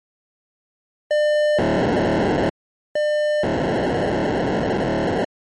POCSAG pager data (1200 baud), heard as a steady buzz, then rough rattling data.